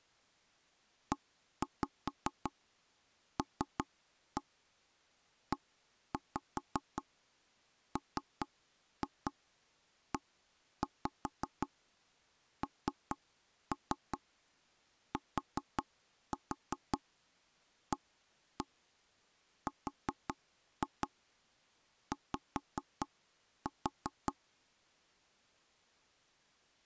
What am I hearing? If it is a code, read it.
Tap code, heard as knocks on wood, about 5 knocks a second. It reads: ELEMENTARY